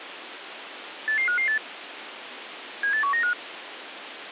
Five-tone selective call (CCIR), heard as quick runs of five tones, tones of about 100 ms, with radio hiss. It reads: 88558 78195